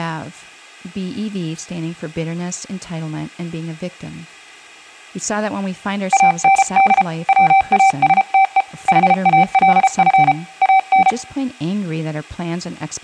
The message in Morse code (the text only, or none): AND WASTE HALF AN